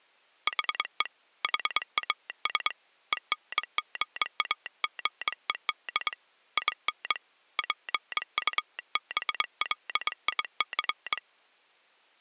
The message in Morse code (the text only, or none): HE HAS ENGAGED IN PUBLIC